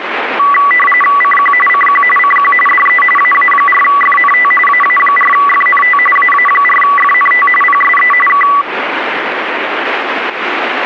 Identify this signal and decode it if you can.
RTTY (45.45 baud, 850 Hz shift), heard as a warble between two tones, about 1550 Hz centre, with radio static. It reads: CQ CQ CQ DE AA4FNT AA4FNT AA4FNT PSE K